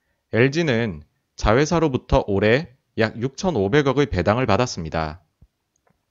Speech in Korean. There is no code.